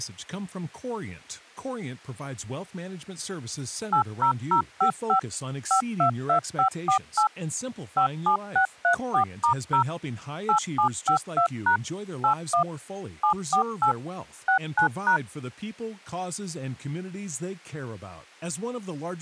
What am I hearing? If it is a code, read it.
DTMF, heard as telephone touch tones, dialled by machine, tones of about 100 ms, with speech in English. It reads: 80055 522548 57634*0 8752# 81 748 69#